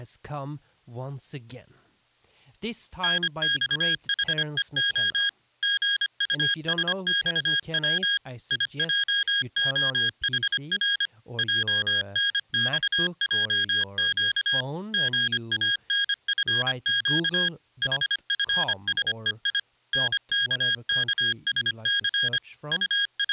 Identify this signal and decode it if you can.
Morse code, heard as electronic beeps, machine-sent, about 25 wpm, 1650 Hz, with speech in English. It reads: NXHEO GUSXW IJOHR JNXJQ GANFQ HFSEI NKKSC …